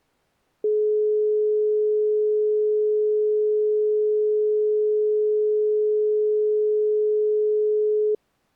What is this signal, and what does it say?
Telephone call progress tone (425 Hz plan, as in most of Europe), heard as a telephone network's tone, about 420 Hz. Dial tone.